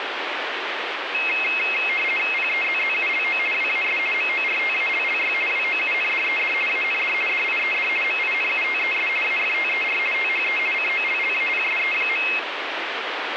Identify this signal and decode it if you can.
RTTY (50 baud, 450 Hz shift), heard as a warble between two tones, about 2350 Hz centre, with radio static. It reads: PEZZULO WAS MORTALLY WOUNDED AND DIED MINUTES AFTER THE COLLAPSE.